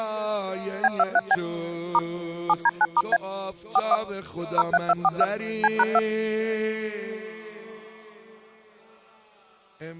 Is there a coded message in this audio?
Yes: DTMF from 0.8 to 6.0 s, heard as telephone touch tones, dialled by machine, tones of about 40 ms. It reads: B23B * 7D9*A 41 03242 C#2